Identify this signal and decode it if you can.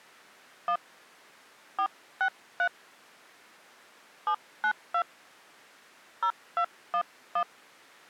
DTMF, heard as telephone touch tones, dialled by hand, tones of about 80 ms. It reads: 1 463 792 0211